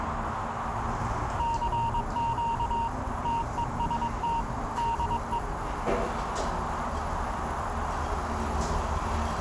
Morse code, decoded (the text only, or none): CQ TEST DE